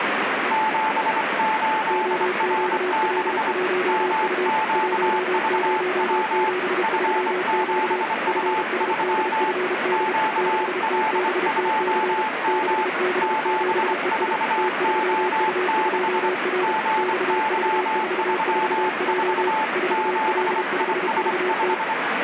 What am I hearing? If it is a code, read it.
Morse code, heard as two keyed tones, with heavy radio static. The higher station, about 25 wpm, 870 Hz: 78R6 MQVW F7U3 QL2M 74O6 GY34 7IS5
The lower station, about 32 wpm, 370 Hz: OQL1U 1073Q FSDFD 6TBTC 6B7EI T3U2R XV44J 4L5VT